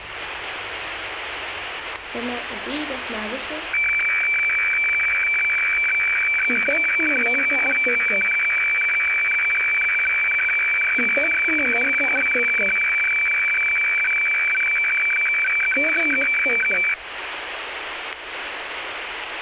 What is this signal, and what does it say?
Weather fax (radiofax), 120 lines a minute, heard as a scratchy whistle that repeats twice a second, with radio static and static crashes.